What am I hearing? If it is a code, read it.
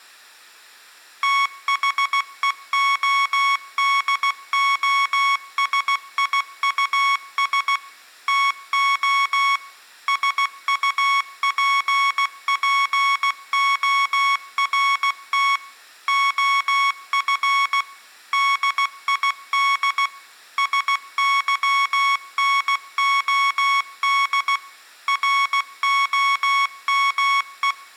Morse code, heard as electronic beeps, machine-sent, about 16 wpm, 1110 Hz, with room echo. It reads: THEODOSIUS TO SUPPORT OF DID SYNOD ROME